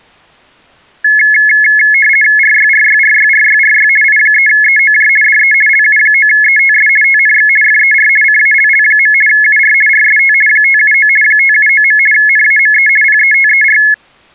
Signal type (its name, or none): RTTY